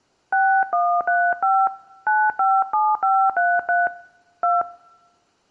DTMF, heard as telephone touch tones, dialled by hand, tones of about 240 ms. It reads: 6135 957533 2